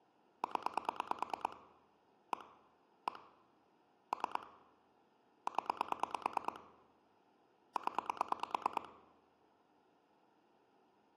Pulse dialling, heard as clicks on a phone line, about 9 pulses a second, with room echo. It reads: 0 1 1 3 0 0